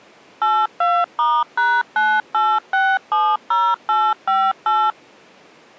DTMF, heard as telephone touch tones, dialled by machine, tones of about 240 ms. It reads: 82*#98670858